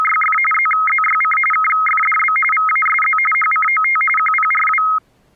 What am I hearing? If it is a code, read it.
RTTY (45.45 baud, 850 Hz shift), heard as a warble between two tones, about 1700 Hz centre. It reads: … ZZYC KFDB VASZ HCOT QPRW